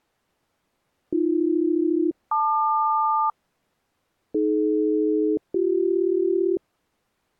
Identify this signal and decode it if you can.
Aircraft SELCAL, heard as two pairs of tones. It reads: AB-LQ AD-BC